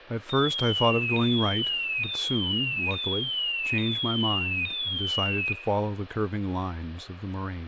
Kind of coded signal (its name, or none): none